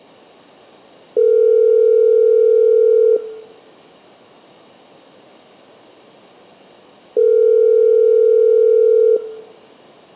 Telephone call progress tone (North American plan), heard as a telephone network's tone, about 440, 480 Hz, 2 s on and 4 s off, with room echo. Ringback tone.